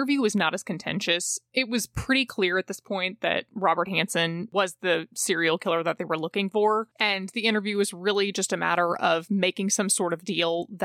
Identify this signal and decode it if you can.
Speech in English. There is no code.